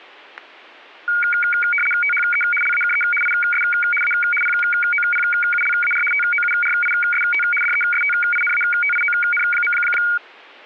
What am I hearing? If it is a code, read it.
RTTY (75 baud, 850 Hz shift), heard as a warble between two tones, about 1850 Hz centre, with static crashes. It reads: THE LAKE IS A POPULAR TOURIST DESTINATION.